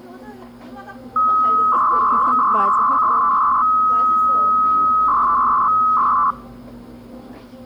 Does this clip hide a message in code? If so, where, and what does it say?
Yes: 300-baud modem data (Bell 103 tones) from 1.2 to 6.3 s, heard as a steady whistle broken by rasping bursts, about 300 baud, 200 Hz shift, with the noise of a cafe.